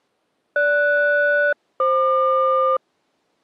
Aircraft SELCAL, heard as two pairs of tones. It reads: GS-FQ